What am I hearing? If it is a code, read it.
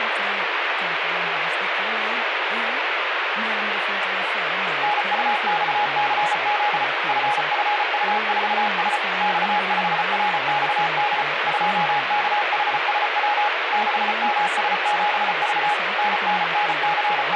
Morse code, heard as a keyed tone, machine-sent, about 34 wpm, 830 Hz, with radio static and speech in Swedish. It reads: NUXCZ FFU4S X5RXD 2KHSW 6MS7V …